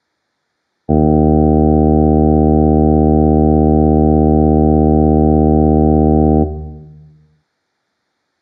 Ship horn signal, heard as a ship's horn, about 80 Hz, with room echo. 1 long. At sea: a vessel nearing a blind bend, or under power and making way in fog.